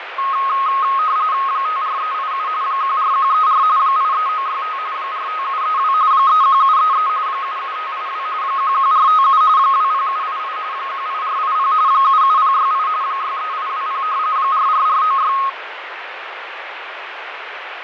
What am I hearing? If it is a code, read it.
RTTY (45.45 baud, 170 Hz shift), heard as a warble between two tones, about 1170 Hz centre, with radio static and fading. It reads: 54387 14134 83965 45732 31733 77582 11457 20788 18480 77068 63820 44496